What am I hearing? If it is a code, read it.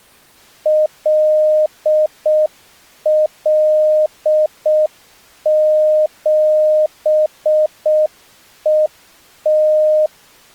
Morse code, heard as a keyed tone, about 6 wpm, 620 Hz. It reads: LL7ET